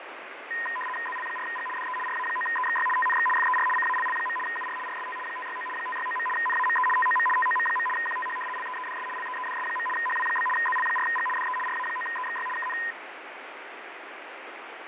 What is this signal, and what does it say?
RTTY (75 baud, 850 Hz shift), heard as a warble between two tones, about 1430 Hz centre, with radio static and fading. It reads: ZL4G DE RA9EXY TNX FER CALL. UR RST 569 569. NAME TOM TOM. QTH LEEDS LEEDS. HW? ZL4G DE RA9EXY KN